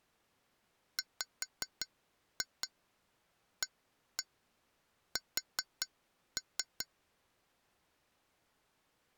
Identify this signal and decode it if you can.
Tap code, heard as taps on glass, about 5 knocks a second. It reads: WAS